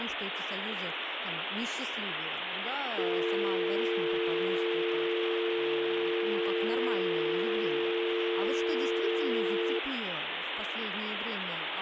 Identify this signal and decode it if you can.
Telephone call progress tone (North American or UK plan), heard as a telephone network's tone, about 350, 450 Hz, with phone line noise and speech in Russian. Dial tone.